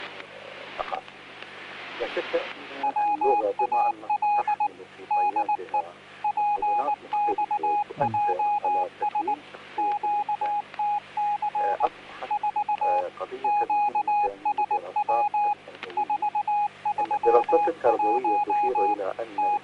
Morse code, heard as a keyed tone, machine-sent, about 19 wpm, 830 Hz, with static crashes. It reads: WAL DE PXJS QTC 4 QSW 431 …